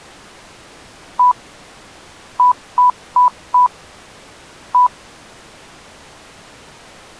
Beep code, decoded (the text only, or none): 1-4-1